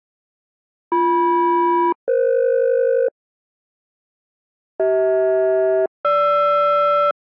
Aircraft SELCAL, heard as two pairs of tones. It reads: BM-EF CH-GR